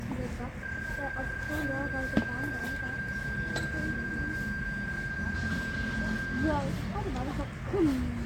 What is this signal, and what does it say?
PSK31 (31.25 baud), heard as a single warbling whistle, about 1600 Hz, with radio static, room echo and the noise of a park.